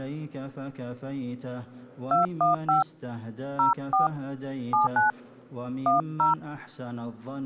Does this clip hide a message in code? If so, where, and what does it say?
Yes: DTMF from 2.1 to 6.3 s, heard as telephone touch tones, dialled by hand, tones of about 140 ms. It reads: 215 04 79 10